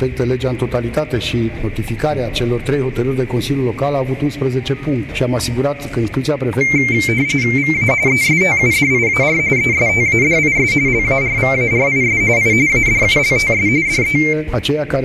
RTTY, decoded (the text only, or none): VA ESTUDIAR ESTADIS LARVARIS I ADULTS DE